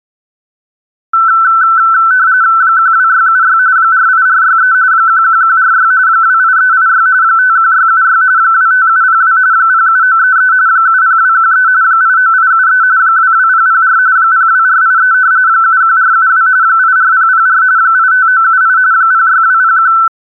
RTTY (45.45 baud, 170 Hz shift), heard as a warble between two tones, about 1420 Hz centre. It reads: 12676 48463 11146 28386 51676 25702 07933 70213 89873 22004 02483 71472 84004 85978 06201